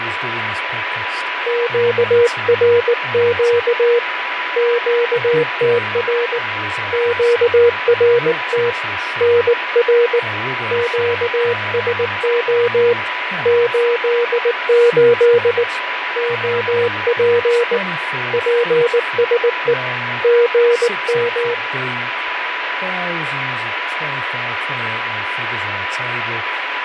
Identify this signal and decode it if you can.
Morse code, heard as a keyed tone, hand-sent with a bug key, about 19 wpm, 480 Hz, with radio static, fading, a steady whistle near 990 Hz and speech in English. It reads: QRQ QTR QRT NR QSO 88 OP PSE GM